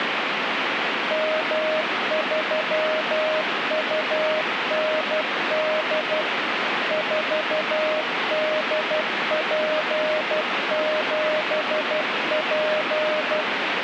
Morse code, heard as a keyed tone, machine-sent, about 12 wpm, 620 Hz, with radio static. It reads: M3UND 4DP7P